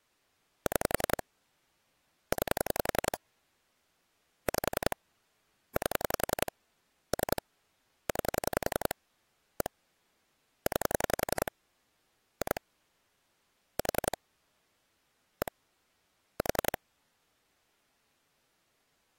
Pulse dialling, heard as clicks on a phone line, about 11 pulses a second. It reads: 6 9 5 8 3 9 1 9 2 4 1 4